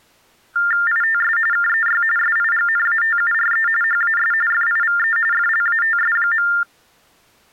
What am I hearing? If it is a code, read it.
TTY/TDD text telephone tones (45.45 baud Baudot), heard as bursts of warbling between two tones, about 400 Hz shift, 1600 Hz centre. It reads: ITS KEY SIGNATURE HAS FIVE FLATS.